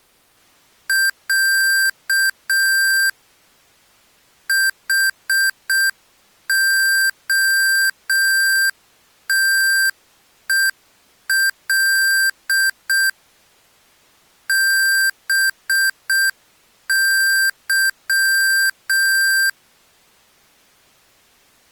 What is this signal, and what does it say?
Morse code (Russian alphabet), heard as electronic beeps, machine-sent, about 6 wpm, 1600 Hz. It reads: Я ХОТЕЛ БЫ